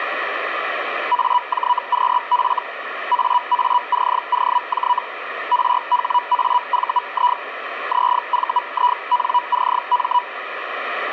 Hellschreiber (Feld-Hell, 122.5 baud), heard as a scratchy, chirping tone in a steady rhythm, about 980 Hz, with radio static. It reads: AJQF AACOJ RHAVI ZVINCM